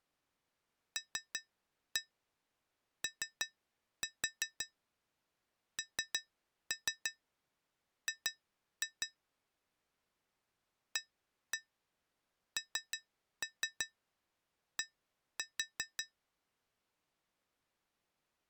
Tap code, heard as taps on glass, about 5 knocks a second. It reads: LONG AND